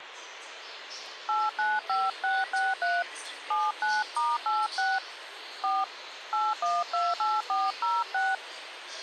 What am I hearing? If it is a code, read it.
DTMF, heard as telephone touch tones, dialled by hand, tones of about 200 ms, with phone line noise and the noise of a subway station. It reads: 895663 79*86 4 8128406